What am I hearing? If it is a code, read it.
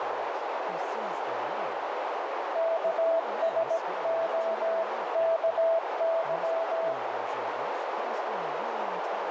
Morse code (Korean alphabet), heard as a keyed tone, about 17 wpm, 660 Hz, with heavy radio static, a narrow filter and speech in English. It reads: 옆에